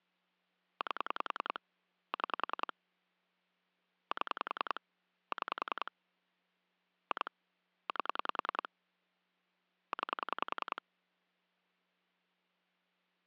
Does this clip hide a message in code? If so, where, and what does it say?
Yes: pulse dialling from 0.8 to 10.8 s, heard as clicks on a phone line, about 10 pulses a second. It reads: 8 6 7 6 2 8 9